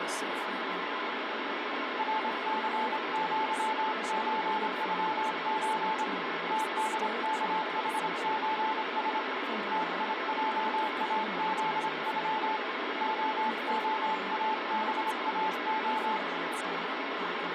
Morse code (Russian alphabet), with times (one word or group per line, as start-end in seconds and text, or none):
2.0-6.0 РЦЪЧЮЧ
6.5-9.2 ТДКХЧС
9.7-12.6 ТИЙАЗЮ
13.0-16.2 ООАБАО